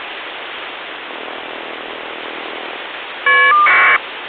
Caller ID data burst, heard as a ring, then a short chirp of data, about 1200 baud, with phone line noise.